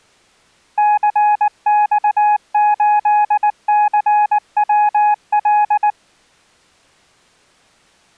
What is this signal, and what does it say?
Morse code, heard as a keyed tone, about 19 wpm, 840 Hz. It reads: CX8CWL